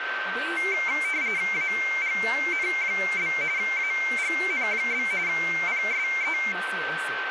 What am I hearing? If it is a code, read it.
RTTY (45.45 baud, 170 Hz shift), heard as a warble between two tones, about 2200 Hz centre, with radio static, a steady whistle near 1550 Hz and speech in Kashmiri. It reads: AGN? AGN? PSE